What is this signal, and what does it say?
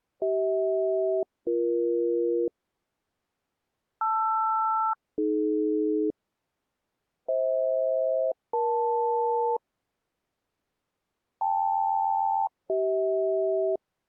Aircraft SELCAL, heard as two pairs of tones. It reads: CH-BE LR-AD FH-EL KL-CH